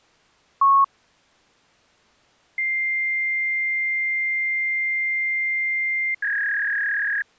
Fax machine handshake, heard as a long tone and a warble.